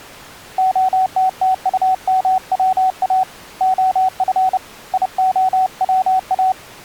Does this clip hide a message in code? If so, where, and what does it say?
Yes: Morse code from 0.5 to 6.6 s, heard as a keyed tone, hand-sent with a paddle, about 30 wpm, 750 Hz. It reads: OTTUMWA OF IOWA